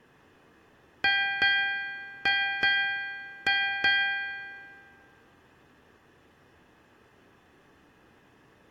Ship's bell, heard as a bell, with room echo. 6. Six half-hours of the watch have passed.